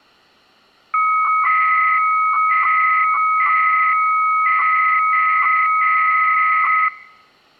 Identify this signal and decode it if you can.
300-baud modem data (Bell 103 tones), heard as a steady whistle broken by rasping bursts, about 300 baud, 200 Hz shift.